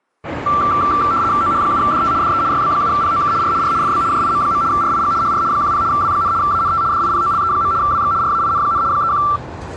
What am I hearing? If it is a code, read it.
RTTY (75 baud, 170 Hz shift), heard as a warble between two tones, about 1260 Hz centre, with street noise. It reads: OH7DT DE YB7POK R R FB JIM. RIG HR 10 W, ANT DIPOLE. WX RAIN, 31